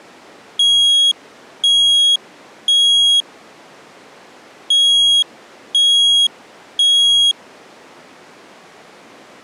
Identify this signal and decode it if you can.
Alarm pattern, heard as an alarm's beeps, played twice, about 3300 Hz. Temporal three. Smoke or fire, evacuate.